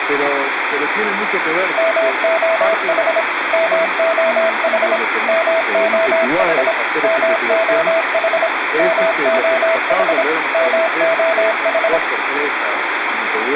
Morse code, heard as a keyed tone, machine-sent, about 26 wpm, 660 Hz, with radio static and room echo. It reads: MOH MOH MOH MOH MOH MOH